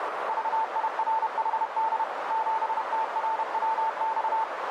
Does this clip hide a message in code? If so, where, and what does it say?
Yes: Morse code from 0.2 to 4.5 s, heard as a keyed tone, machine-sent, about 31 wpm, 890 Hz, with heavy radio static and a narrow filter. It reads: VIRHD 7TRWX